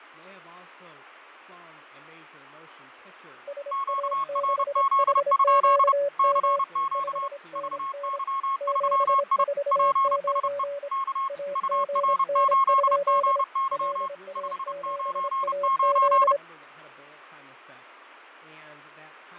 Morse code, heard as two keyed tones, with radio static, fading and speech in English. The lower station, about 26 wpm, 570 Hz: SA6HQM 5NN 749 AGN? LA7AZ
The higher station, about 30 wpm, 1080 Hz: QRZ? CQ VY3I PSE K UR8GY 599